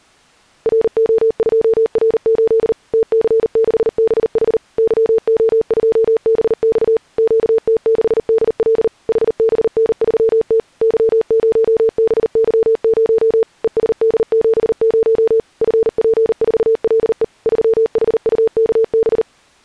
Morse code, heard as a keyed tone, machine-sent, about 39 wpm, 450 Hz. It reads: RO2R8 TC6BH YO2BX QT6DL HBN3T Y0BY0 ESD70 FP4LE 3HUKB